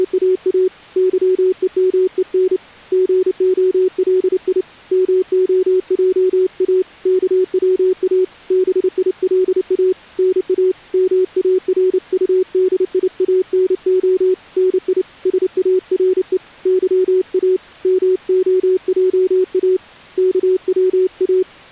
Morse code, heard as a keyed tone, hand-sent with a paddle, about 29 wpm, 370 Hz. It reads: … YEMEN GOLI MOJA KWA BILA NA MARUDIANO NI SARE YA MOJA KWA